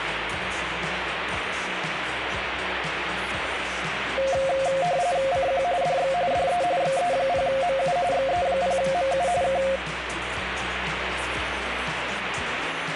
RTTY (45.45 baud, 170 Hz shift), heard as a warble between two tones, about 620 Hz centre, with radio static. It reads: CQ DX DE XE0MU XE0MU K